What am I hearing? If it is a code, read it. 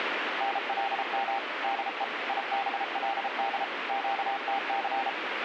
Morse code, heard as a keyed tone, machine-sent, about 33 wpm, 790 Hz, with radio static. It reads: NLM DE IBLD QTC